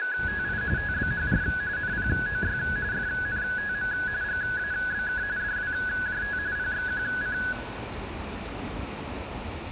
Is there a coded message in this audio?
Yes: RTTY (45.45 baud, 170 Hz shift) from 0.0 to 7.5 s, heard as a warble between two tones, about 1600 Hz centre, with room echo and the noise of a residential street. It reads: … TBHR NPOY FNTM GABK DWJT PXQC